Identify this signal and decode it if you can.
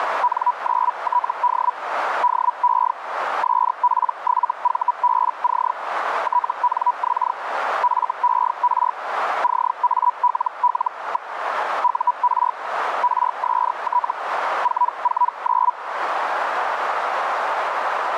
Hellschreiber (Feld-Hell, 122.5 baud), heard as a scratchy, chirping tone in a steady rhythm, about 980 Hz, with radio static and a narrow filter. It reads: N9TD DE SP7VBC TNX FER CALL. UR RST 449